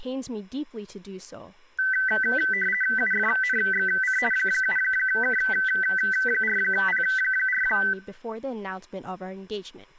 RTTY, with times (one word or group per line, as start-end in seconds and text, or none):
3.0-4.2 UFNXC
4.3-7.6 7K4P4